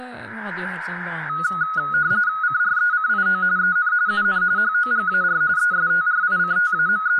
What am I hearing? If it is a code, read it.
RTTY (45.45 baud, 170 Hz shift), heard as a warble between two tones, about 1360 Hz centre, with speech in Norwegian. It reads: CRECIO EN UN HOGAR …